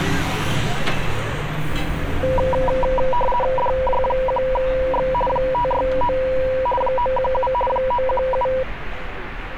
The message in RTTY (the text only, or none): DJ1X 569 917 917